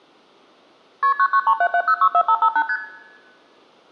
Multi-frequency trunk signalling (R1, as on North American trunks), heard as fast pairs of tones, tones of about 70 ms, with room echo. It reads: KP 99377064558 ST